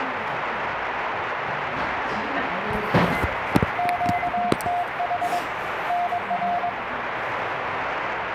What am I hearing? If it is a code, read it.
Morse code, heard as a keyed tone, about 22 wpm, 710 Hz, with radio static and the noise of a cafe. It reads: QTH NR